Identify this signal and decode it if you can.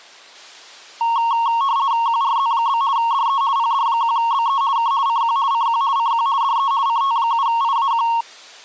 RTTY (50 baud, 170 Hz shift), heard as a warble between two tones, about 1010 Hz centre. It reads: QRZ? DE PD1BE K CQ CQ CQ DE CT7IAQ